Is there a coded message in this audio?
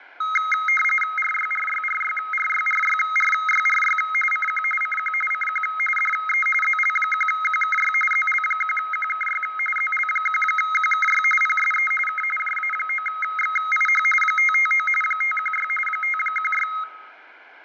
Yes: RTTY (45.45 baud, 850 Hz shift) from 0.2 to 16.8 s, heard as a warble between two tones, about 1700 Hz centre. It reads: RYRYRYRYRYRYRY CQ CQ CQ DE ZL1QKY ZL1QKY ZL1QKY PSE K JA9XIH 559 516 516